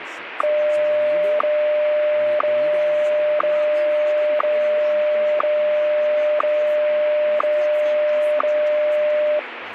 Radio time signal (WWVH, Hawaii), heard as ticks, one a second, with radio static and speech in English.